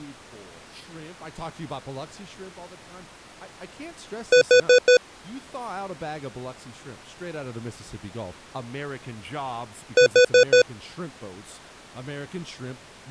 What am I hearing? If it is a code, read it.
Alarm pattern, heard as an alarm's beeps, played twice, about 500 Hz, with speech in English. Temporal four. Carbon monoxide.